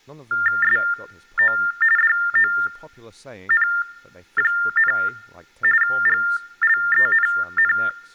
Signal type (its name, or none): TTY/TDD text telephone tones